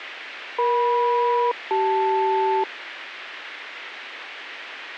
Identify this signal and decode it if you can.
Aircraft SELCAL, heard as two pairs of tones, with radio hiss. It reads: EM-CL